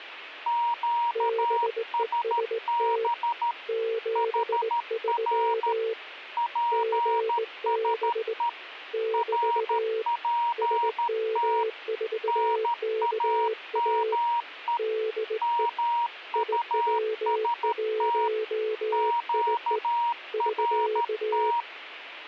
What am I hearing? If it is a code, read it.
Morse code, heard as two keyed tones. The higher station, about 13 wpm, 940 Hz: QSB HR PSE RPT NAME MUST QRT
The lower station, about 18 wpm, 440 Hz: BEST 73 GB <BT> SM4KA DE IW1IE <SK>